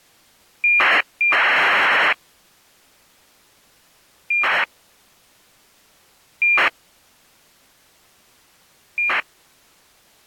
ACARS aircraft data, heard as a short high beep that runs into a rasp, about 2400 baud.